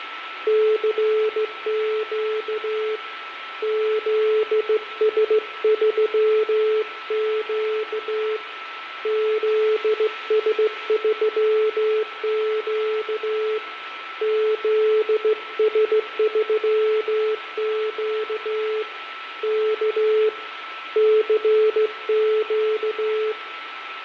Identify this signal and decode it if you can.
Morse code, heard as a keyed tone, hand-sent with a straight key, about 16 wpm, 430 Hz, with radio static, fading, a steady whistle near 1320 Hz and room echo. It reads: CQ ZS3Q ZS3Q ZS3Q K CQ